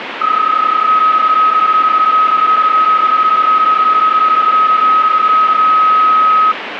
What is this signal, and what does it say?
PSK31 (31.25 baud), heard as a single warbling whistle, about 1270 Hz, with radio static.